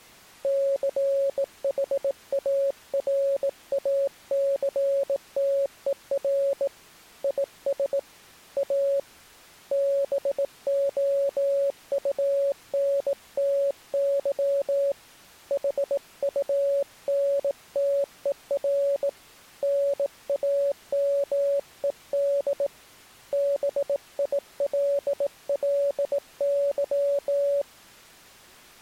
Morse code, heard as a keyed tone, hand-sent with a bug key, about 18 wpm, 560 Hz. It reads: CHARACTER IS A BOUNTY HUNTER NAMED BILLY